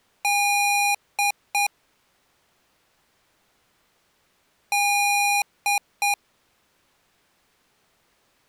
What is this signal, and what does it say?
Beep code, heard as beeps from a small speaker, played twice, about 810 Hz. 1 long, 2 short. In Award, IBM and AMI BIOS tables: video adapter failure.